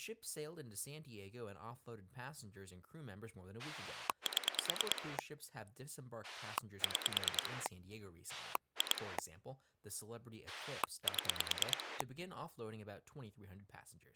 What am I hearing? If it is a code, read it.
Pulse dialling, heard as a rotary dial, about 9 pulses a second, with speech in English. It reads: 7 6 2 7